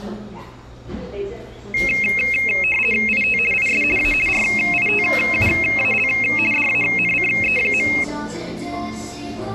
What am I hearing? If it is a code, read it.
RTTY (50 baud, 450 Hz shift), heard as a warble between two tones, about 2350 Hz centre, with the noise of a cafe. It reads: IT IS A RITUAL DANCE.